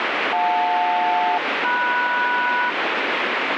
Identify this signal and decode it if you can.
Aircraft SELCAL, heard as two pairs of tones, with heavy radio static. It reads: JL-MS